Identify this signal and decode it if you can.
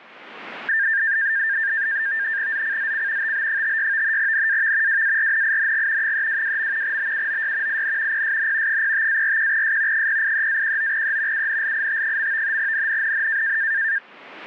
NAVTEX (SITOR-B), 100 baud, 170 Hz shift, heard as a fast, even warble, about 1700 Hz centre. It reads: ZCZC TB56 NAV WARNING 322. BUOY IN PSN 05-41S 083-19E UNLIT. NNNN